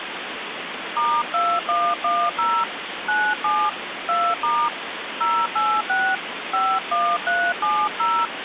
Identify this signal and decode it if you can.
DTMF, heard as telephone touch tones, dialled by hand, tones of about 260 ms, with phone line noise. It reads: *2110 97 2* 086 51370